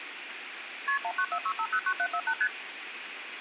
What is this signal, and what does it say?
Multi-frequency trunk signalling (R1, as on North American trunks), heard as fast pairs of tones, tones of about 70 ms, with phone line noise. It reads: KP 1946509748 ST